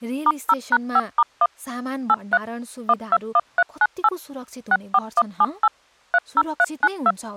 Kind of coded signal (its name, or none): DTMF